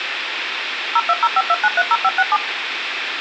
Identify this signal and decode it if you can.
DTMF, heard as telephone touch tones, dialled by machine, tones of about 50 ms, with phone line noise. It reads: 02052930567